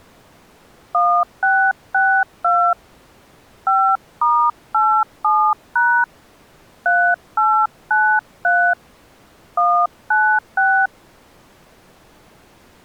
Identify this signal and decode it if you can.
DTMF, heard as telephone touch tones, dialled by hand, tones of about 290 ms. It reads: 1662 5*87# 3893 196